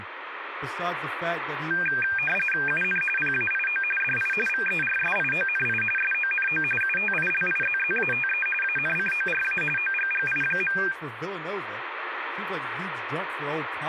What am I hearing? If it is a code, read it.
RTTY (45.45 baud, 850 Hz shift), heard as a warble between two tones, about 2000 Hz centre, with radio static and speech in English. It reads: UN PAIO DI VERSIONI SONO UTILIZZATE ANCORA OGGI.